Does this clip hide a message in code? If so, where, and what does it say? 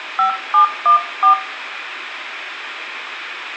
Yes: DTMF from 0.2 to 1.3 s, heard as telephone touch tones, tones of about 110 ms, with phone line noise and room echo. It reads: 5714